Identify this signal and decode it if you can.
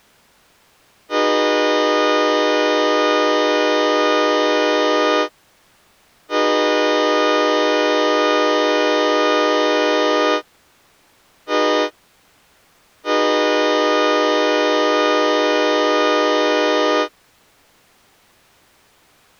Train horn signal, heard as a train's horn. 2 long, 1 short, 1 long. On North American railways: approaching a public crossing.